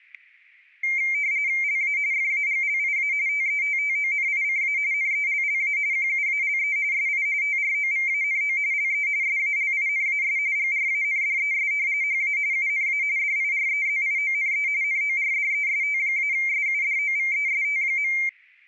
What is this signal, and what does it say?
RTTY (45.45 baud, 170 Hz shift), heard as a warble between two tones, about 2200 Hz centre, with static crashes. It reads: LA FAGLIA TETTONICA NELLA QUALE SI TROVANO LE SALINAS GRANDES HA UNA DIREZIONE NORDEST-SUDOVEST.